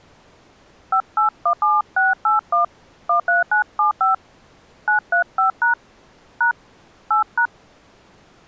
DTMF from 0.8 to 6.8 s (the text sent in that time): 5817681 13975 935# #